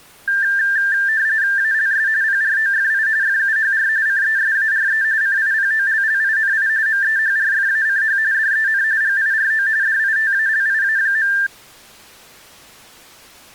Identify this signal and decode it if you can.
RTTY (45.45 baud, 170 Hz shift), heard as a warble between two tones, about 1700 Hz centre. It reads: ALS PROFI FUHR CESARE CIPOLLINI MEHRFACH DEN GIRO DITALIA.